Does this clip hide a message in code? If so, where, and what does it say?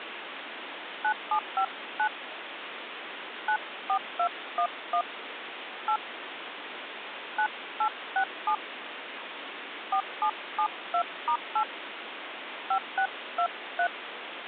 Yes: DTMF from 1.0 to 13.9 s, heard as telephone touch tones, dialled by hand, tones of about 80 ms, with phone line noise. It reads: 9759 94211 8 9867 4772*8 5623